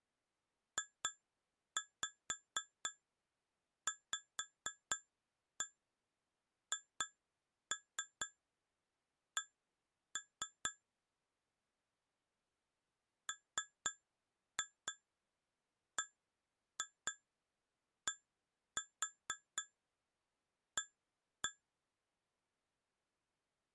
Tap code, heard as taps on glass, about 4 knocks a second. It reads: JVHC MBDA